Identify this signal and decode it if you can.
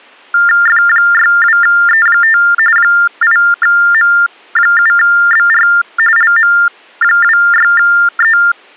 TTY/TDD text telephone tones (45.45 baud Baudot), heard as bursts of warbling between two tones, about 400 Hz shift, 1600 Hz centre. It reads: F62E5 8M7BR LM26E